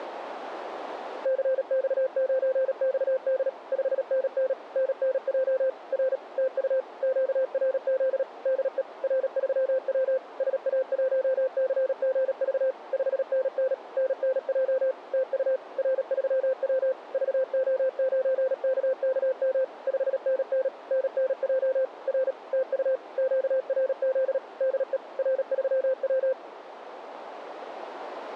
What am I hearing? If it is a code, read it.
Morse code, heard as a keyed tone, machine-sent, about 37 wpm, 520 Hz, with radio static. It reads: CX9XD 5NN NNJ R TU QRZ DE R3W SA1CGV 5NN NNJ TU R3W VO9KKM 5NN NNJ R TU QRZ DE R3W